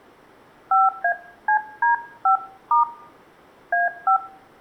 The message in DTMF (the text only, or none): 5ACD5* A5